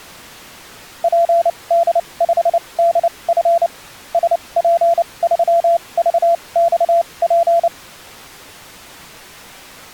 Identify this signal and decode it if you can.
Morse code, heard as a keyed tone, machine-sent, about 29 wpm, spaced as for 23 wpm, 680 Hz. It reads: PD5DF SP3VXP